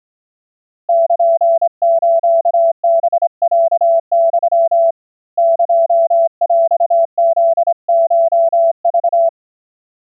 Morse code (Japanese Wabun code), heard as a keyed tone, hand-sent with a straight key, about 26 wpm, 660 Hz. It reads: ルスハロユ エヰフコク